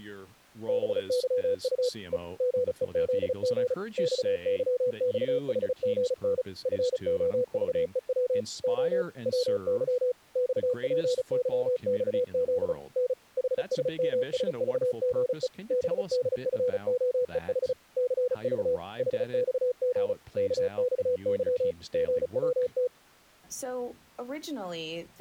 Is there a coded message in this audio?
Yes: Morse code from 0.6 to 22.9 s, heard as a keyed tone, machine-sent, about 35 wpm, 500 Hz, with speech in English. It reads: BYU E GEZG XYXHGN FOVEW O WY XPYXZ N HSMSVGE BDFOEH CV HXG KXY GWT